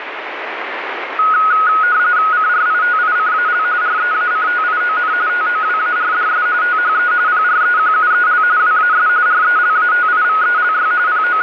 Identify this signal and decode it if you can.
RTTY (45.45 baud, 170 Hz shift), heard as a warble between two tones, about 1360 Hz centre, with radio static. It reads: CRITICAL REACTION TOWARDS THE PREQUEL WAS RELATIVELY …